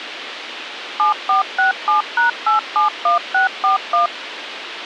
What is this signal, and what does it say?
DTMF, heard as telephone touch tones, dialled by machine, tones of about 130 ms, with radio hiss and a squelch burst at the end. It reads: 7467#871641